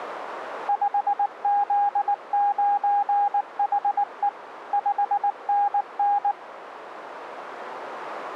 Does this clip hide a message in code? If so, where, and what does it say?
Yes: Morse code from 0.6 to 6.4 s, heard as a keyed tone, machine-sent, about 19 wpm, 810 Hz, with radio static. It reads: 5Z9HE 5NN